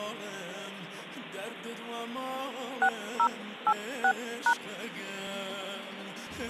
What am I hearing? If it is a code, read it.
DTMF, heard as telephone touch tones, dialled by hand, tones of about 70 ms. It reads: 6086#